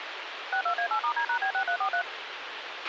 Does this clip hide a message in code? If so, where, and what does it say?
Yes: DTMF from 0.5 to 2.0 s, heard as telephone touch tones, dialled by machine, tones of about 80 ms, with radio hiss and a squelch burst at the end. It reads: 62A8*D#B6343